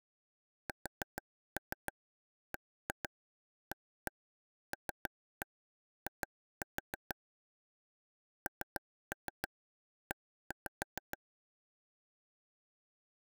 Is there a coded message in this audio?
Yes: tap code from 0.7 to 11.2 s, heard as taps on a table, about 6 knocks a second. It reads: SBALI NE